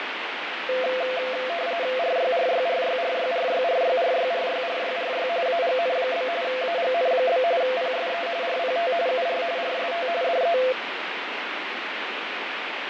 RTTY (45.45 baud, 170 Hz shift), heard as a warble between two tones, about 600 Hz centre, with radio static and fading. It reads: RYRYRYRYRYRYRYRYRYRY AGN? AGN? PSE RPT UR RST DE